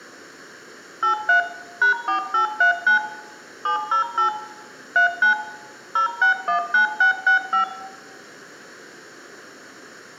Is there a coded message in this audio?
Yes: DTMF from 1.0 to 7.6 s, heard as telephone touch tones, dialled by machine, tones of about 110 ms, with room echo. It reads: 83 #4839 708 39 0619665